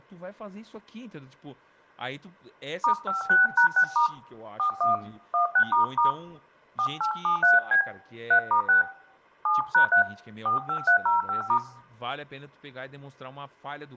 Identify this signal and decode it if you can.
DTMF, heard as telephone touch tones, dialled by hand, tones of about 120 ms, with room echo and speech in Portuguese. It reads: *56#6* 41 16** 4873B 3*6 7#3 45305*